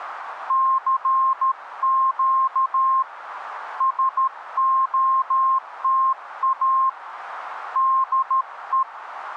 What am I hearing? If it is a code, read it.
Morse code, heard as a keyed tone, hand-sent with a paddle, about 13 wpm, 1060 Hz, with radio static. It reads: CQ SOTA DE